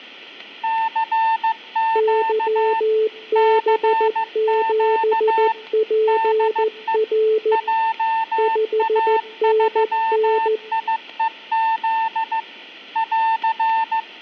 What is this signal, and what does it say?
Morse code, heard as two keyed tones. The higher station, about 15 wpm, 900 Hz: CQ CQ DE JA3IEZ <AR>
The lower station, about 14 wpm, 440 Hz: YB7PR 5NN